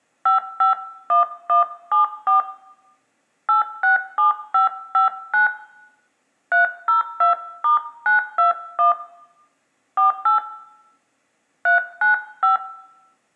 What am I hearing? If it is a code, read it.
DTMF, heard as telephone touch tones, dialled by hand, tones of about 130 ms, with room echo. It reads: 551174 867559 302*921 48 395